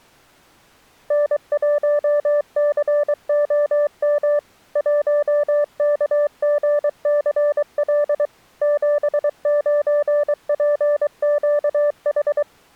Morse code, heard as a keyed tone, machine-sent, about 23 wpm, 590 Hz. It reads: N1COM 1KGCL 79PQH